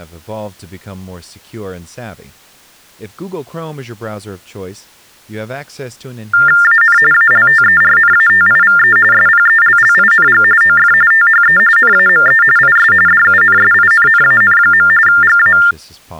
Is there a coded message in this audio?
Yes: TTY/TDD text telephone tones (45.45 baud Baudot) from 6.3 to 15.7 s, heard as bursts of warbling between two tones, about 400 Hz shift, 1600 Hz centre, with speech in English. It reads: AN ALTERNATIVE SPELLING OF THE NAME IS DUNSINNAN. GA